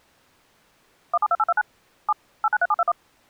DTMF, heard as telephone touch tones, dialled by machine, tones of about 40 ms. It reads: 172829 7 893721